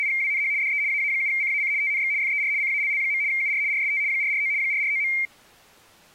RTTY (75 baud, 170 Hz shift), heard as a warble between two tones, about 2200 Hz centre. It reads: … DE AA7CAC TNX FER CALL. UR RST 449 449.